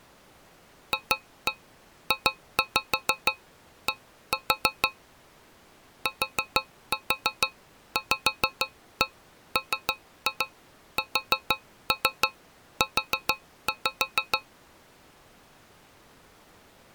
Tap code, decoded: FJD TVMSU

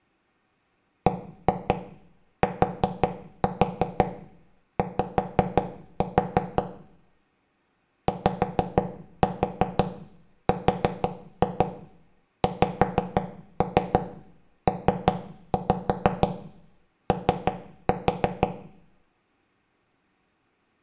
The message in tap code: BTY YRXPO

